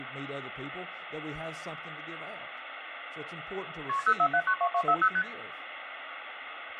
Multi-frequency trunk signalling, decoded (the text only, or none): KP 04792240 ST